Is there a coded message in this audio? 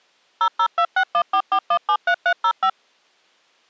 Yes: DTMF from 0.4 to 2.7 s, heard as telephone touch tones, dialled by machine, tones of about 70 ms. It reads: 0026144173305